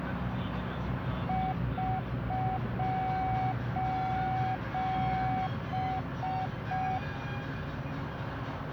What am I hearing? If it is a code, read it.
Morse code, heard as a keyed tone, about 5 wpm, 750 Hz, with radio static and the noise inside a bus. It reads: <SOS>